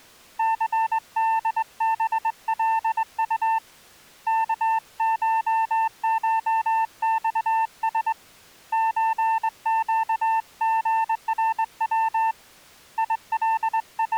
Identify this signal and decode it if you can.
Morse code (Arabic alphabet), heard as a keyed tone, hand-sent with a straight key, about 21 wpm, 900 Hz. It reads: ثدبلط كششصس زقغرو …